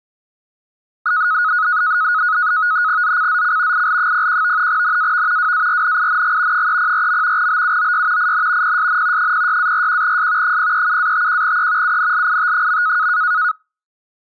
NAVTEX (SITOR-B), 100 baud, 170 Hz shift, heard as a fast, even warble, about 1360 Hz centre. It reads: ZCZC IL01 NAV WARNING 304. BUOY IN PSN 06-41S 037-51E UNLIT.